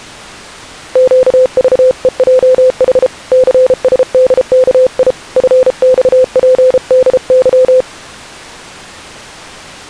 Morse code, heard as a keyed tone, hand-sent with a paddle, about 33 wpm, 510 Hz. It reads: QVEJH CSDKI FXPDY